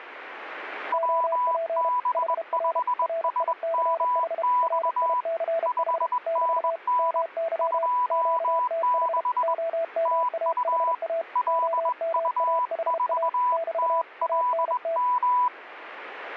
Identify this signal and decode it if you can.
Morse code, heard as two keyed tones. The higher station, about 21 wpm, 990 Hz: WB5SMX 5NN 26 TU LU4TLM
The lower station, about 32 wpm, 660 Hz: OP HR RICH RICH <BT> MY QTH OMAHA OMAHA <BT> ANT